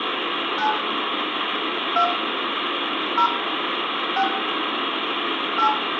DTMF, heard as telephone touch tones, dialled by hand, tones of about 80 ms, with phone line noise and room echo. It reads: 9 2 0 6 8